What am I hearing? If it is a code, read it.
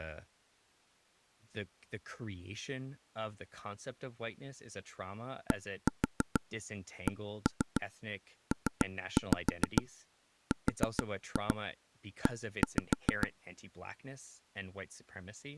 Tap code, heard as taps on a table, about 6 knocks a second, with speech in English. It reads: DCPRE